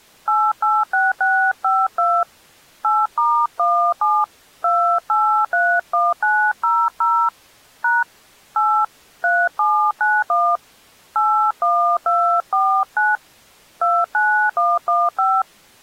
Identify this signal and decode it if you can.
DTMF, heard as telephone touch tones, dialled by hand, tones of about 270 ms. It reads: 886652 8*17 2831900 # 8 3791 81249 29115